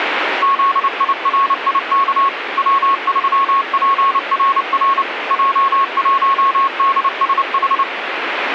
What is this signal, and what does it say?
Morse code, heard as a keyed tone, machine-sent, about 29 wpm, 1100 Hz, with radio static. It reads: ZIRIK W3PRR J1DSH